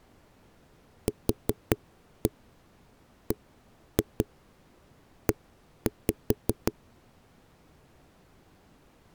Tap code, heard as knocks on a wall, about 5 knocks a second. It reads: QBE